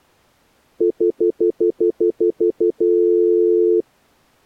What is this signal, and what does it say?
Telephone call progress tone (North American plan), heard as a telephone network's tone, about 350, 440 Hz, 0.1 s on and 0.1 s off. Stutter dial tone.